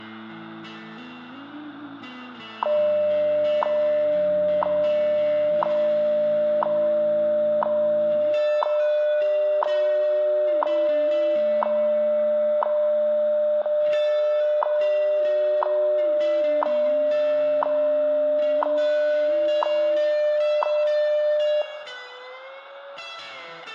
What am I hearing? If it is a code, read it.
Radio time signal (WWV, Colorado), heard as ticks, one a second, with room echo.